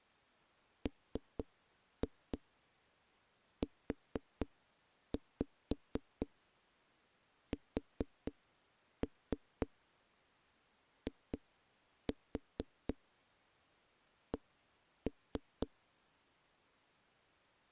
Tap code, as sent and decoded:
3-2 4-5 4-3 2-4 1-3
MUSIC

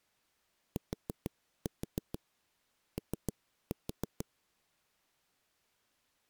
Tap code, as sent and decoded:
4-4 3-4
TO

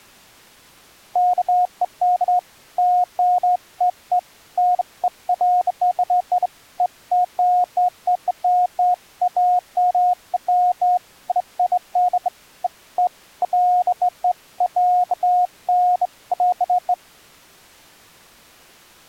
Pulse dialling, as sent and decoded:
none

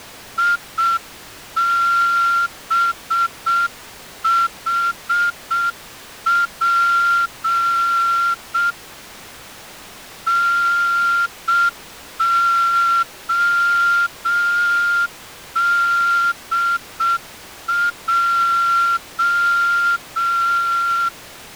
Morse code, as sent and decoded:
.. -... .... .--. / -. --- -.. .---
IBHP NODJ

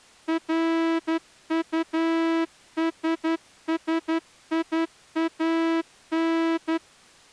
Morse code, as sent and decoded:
.-. ..- ... ... .. .- -.
RUSSIAN

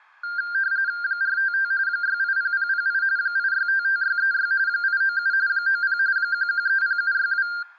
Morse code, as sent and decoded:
none

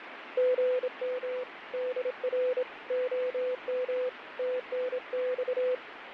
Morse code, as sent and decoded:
--. -- / -.. .-. / --- -- / - -. -..-
GM DR OM TNX

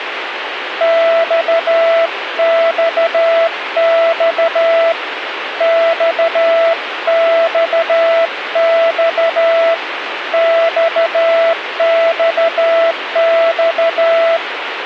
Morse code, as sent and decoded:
-..- -..- -..- / -..- -..- -..- / -..- -..- -..-
XXX XXX XXX

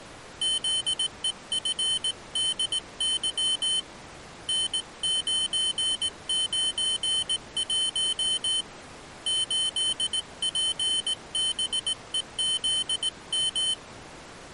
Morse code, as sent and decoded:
--.. . ..-. -.. -.-- / -. ----. ----. .---- / ---.. .--. -... . --.. --
ZEFDY N991 8PBEZM

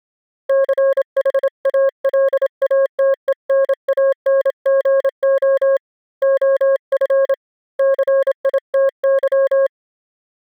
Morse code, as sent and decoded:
-.-. .... .- .-.. .- - . -. .- -. --. --- / --- ..-. / -.-. .. - -.--
CHALATENANGO OF CITY

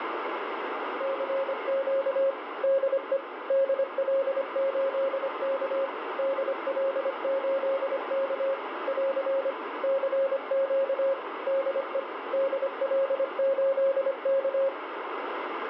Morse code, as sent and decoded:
-.-. --.- / -.. . / -.. .-.. ---.. -.- / -.. .-.. ---.. -.- / .-.-. / -.-. --.- / -.. . / -.. .-.. ---.. -.-
CQ DE DL8K DL8K <AR> CQ DE DL8K

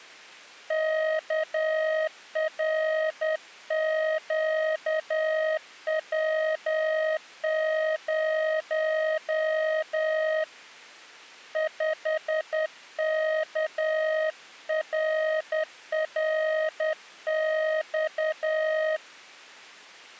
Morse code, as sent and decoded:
-.- .-. --.- .-- ----- / ..... -.- .-. .-. -..-
KRQW0 5KRRX

